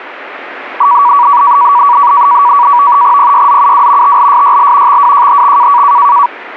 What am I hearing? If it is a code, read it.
NAVTEX (SITOR-B), 100 baud, 170 Hz shift, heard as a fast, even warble, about 1050 Hz centre. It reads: PYZUW TLSYL XWJHX